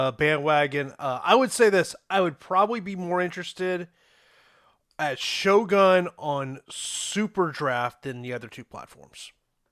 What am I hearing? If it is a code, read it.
Speech in English. There is no code.